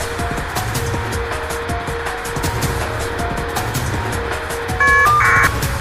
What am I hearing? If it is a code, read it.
Caller ID data burst, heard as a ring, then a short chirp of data, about 1200 baud, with phone line noise.